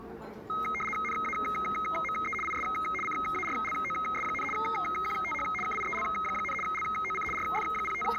RTTY (75 baud, 850 Hz shift), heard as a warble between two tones, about 1700 Hz centre, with the noise of a crowd indoors. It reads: NAME IS CARLOS, QTH KIEL, LOC …